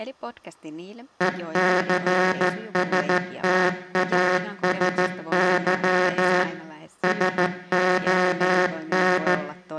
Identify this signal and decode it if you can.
Morse code, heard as a buzzer, machine-sent, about 14 wpm, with room echo and speech in Finnish. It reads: ECSTASY SON